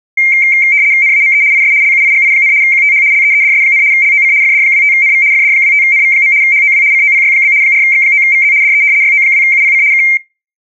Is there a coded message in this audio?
Yes: RTTY (75 baud, 170 Hz shift) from 0.2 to 10.2 s, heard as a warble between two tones, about 2200 Hz centre. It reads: NAME IS LUIGI, QTH LEEDS, LOC FD25NV FD25NV. HOW COPY? 4X9VZ DE YO2UPC K